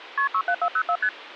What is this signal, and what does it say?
Multi-frequency trunk signalling (R1, as on North American trunks), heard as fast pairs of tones, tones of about 70 ms. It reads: KP 67404 ST